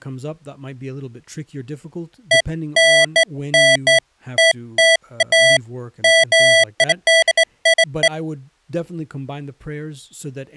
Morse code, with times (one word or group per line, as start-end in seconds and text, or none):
none